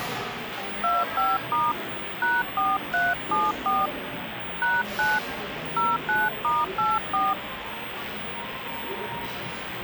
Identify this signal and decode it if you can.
DTMF, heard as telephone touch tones, dialled by hand, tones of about 200 ms, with phone line noise and the noise of a cafe. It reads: 25* #4374 #9 09*84